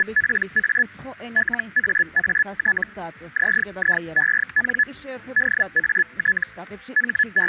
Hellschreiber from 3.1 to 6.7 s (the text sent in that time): ZIEN DAT